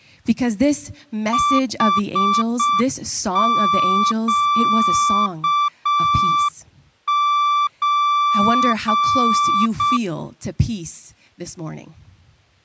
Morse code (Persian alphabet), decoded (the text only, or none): حگچ